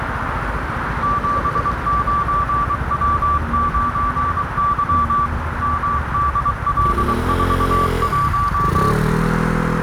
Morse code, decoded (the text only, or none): 79W9Y MDL41